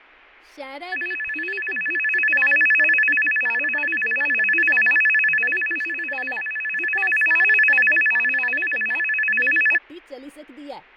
A tone that alternates evenly between two pitches, with fading and speech in Dogri. There is no code.